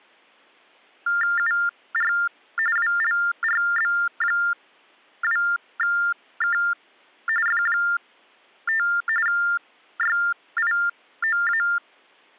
TTY/TDD text telephone tones (45.45 baud Baudot), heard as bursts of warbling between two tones, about 400 Hz shift, 1600 Hz centre. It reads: UR WLRB2K F5 YIOA